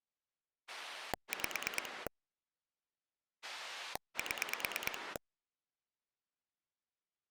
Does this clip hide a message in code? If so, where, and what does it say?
Yes: pulse dialling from 0.7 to 5.2 s, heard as a rotary dial, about 9 pulses a second. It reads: 5 7